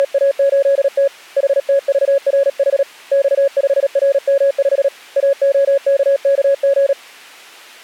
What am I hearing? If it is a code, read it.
Morse code, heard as a keyed tone, hand-sent with a paddle, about 37 wpm, 550 Hz. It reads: … HTVRH X5RM5 AOKKG